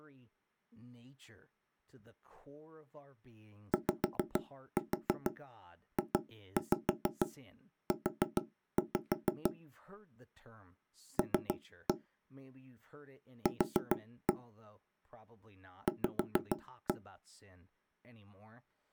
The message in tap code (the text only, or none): YJU L Q V